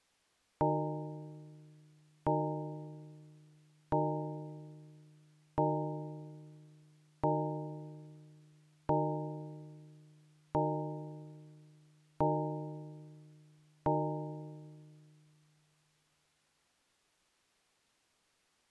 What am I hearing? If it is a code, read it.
Clock strike, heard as a bell. 9. Nine o'clock.